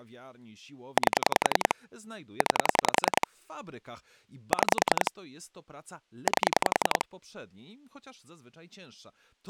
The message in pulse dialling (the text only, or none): 8 9 6 8